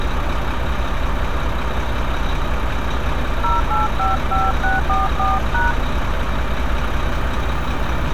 DTMF, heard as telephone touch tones, dialled by hand, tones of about 160 ms, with street noise. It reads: 0855644#